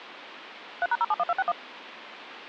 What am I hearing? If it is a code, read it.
DTMF, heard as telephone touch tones, dialled by machine, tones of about 40 ms. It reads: 3#071261